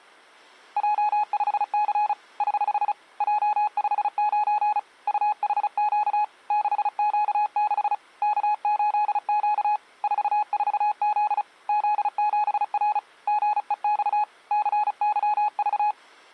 Morse code, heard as a keyed tone, hand-sent with a paddle, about 35 wpm, 840 Hz. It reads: J5C <HH> J59 UHQ 6Q6 K8Q 44Z Z7R GEX CYV